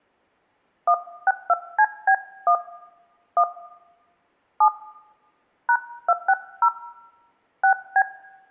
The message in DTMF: 162CB1 1 7 #260 6B

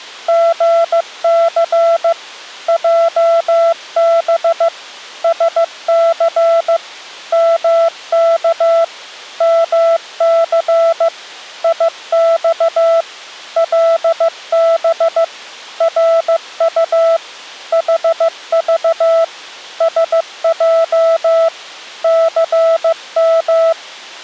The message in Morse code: GC JB SC MK MC IX LB RU HV SJ CM

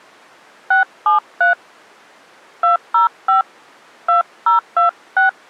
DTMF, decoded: 673 205 2026

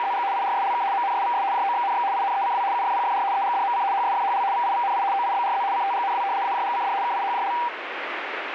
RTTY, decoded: … IRSLK MNSVS JOXNX INECW UFPFR EGDMC HSFHL VIVNI OIBRZ CTGNW AJGCD KIHJL

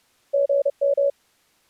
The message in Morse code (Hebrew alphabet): גם

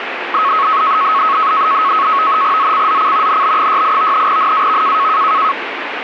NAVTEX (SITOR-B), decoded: ZCZC NB68 NAV

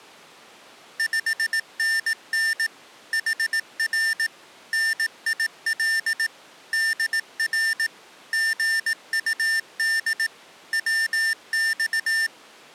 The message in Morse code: 5NN HR NIL DR GUD WX

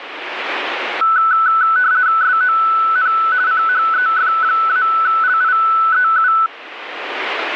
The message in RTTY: SON CHEF-LIEU

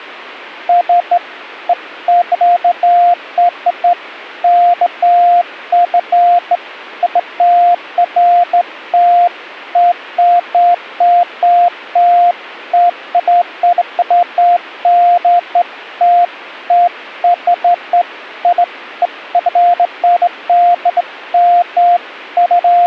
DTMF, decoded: none

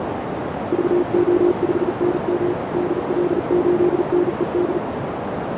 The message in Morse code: VO5NM DL8NED

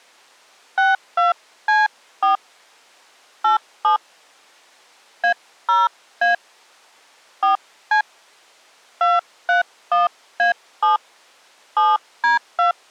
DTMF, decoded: 62C4 87 A0A 4C 231A7 7D2

